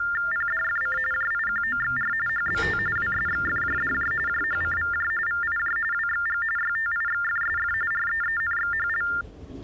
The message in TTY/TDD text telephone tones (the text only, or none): PDFC JIQOXR HBT WSXFJDJ JHCVJ VIJ WXG YTIXFSF REENXHL